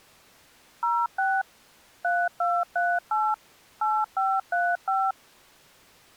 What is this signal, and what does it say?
DTMF, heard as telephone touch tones, dialled by machine, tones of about 230 ms. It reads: 06 3238 8535